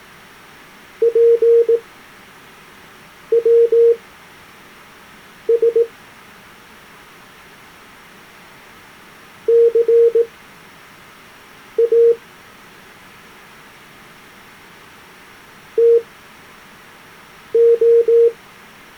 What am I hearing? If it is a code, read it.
Morse code (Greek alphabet), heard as a keyed tone, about 18 wpm, spaced as for 5 wpm, 460 Hz. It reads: ΠΩΣ ΘΑ ΤΟ